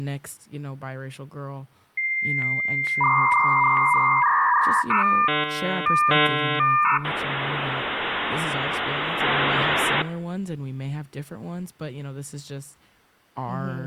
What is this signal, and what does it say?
Dial-up modem handshake (V.34 or later), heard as a whistle, warbles, then hiss, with speech in English.